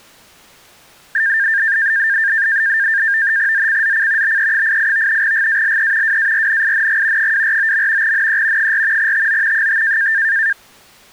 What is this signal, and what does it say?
NAVTEX (SITOR-B), 100 baud, 170 Hz shift, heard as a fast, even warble, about 1700 Hz centre. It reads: ZCZC BE88 GALE WARNING 249. NE 4 TO 5